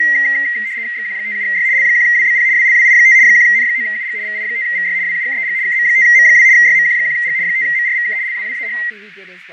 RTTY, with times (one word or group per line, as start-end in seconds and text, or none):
1.0-1.7 XQ57Y
1.8-2.5 L1WBP
2.6-3.2 WLWI5
3.2-4.2 1N9UG
4.2-5.0 VI5VY
5.1-5.6 WUKEG
5.7-6.5 KM5M2
6.6-7.4 YMQ1G
7.5-8.2 5MRVK
8.2-8.8 LWWAH